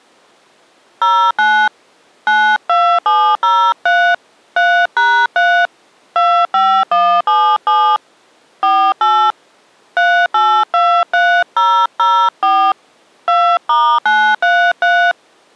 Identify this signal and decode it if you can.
DTMF, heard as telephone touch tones, dialled by hand, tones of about 290 ms. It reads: 09 92703 3#3 25177 48 3823004 2*933